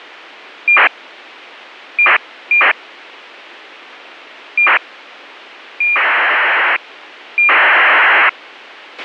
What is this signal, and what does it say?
ACARS aircraft data, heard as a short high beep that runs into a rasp, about 2400 baud, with a squelch burst at the end.